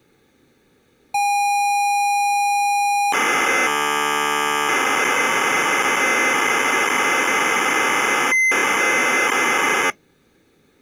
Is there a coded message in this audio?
Yes: ZX Spectrum tape loading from 1.1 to 9.9 s, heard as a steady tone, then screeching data.